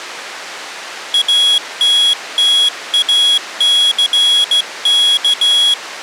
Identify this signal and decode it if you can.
Morse code, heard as a high beeper, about 15 wpm, 3350 Hz. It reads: ATTACK